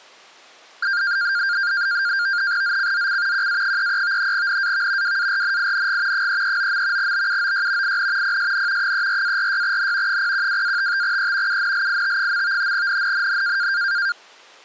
NAVTEX (SITOR-B), 100 baud, 170 Hz shift, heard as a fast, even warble, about 1500 Hz centre. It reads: ZCZC QA33 NAV WARNING 339. BUOY IN PSN 34-46N 012-55E UNLIT. NNNN